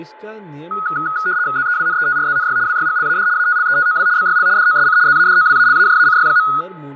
RTTY (75 baud, 170 Hz shift), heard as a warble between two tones, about 1360 Hz centre, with fading, a steady whistle near 860 Hz and speech in Hindi. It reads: ZEWNETRZNY WYGLAD ATLETOW BYL DOSC ZADOWALAJACY.